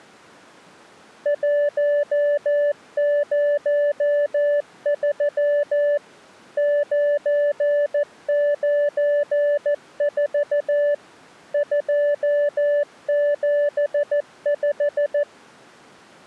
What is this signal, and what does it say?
Morse code, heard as a keyed tone, machine-sent, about 14 wpm, 580 Hz. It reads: 103 994 275